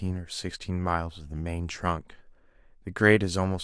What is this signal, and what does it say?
Speech in English. There is no code.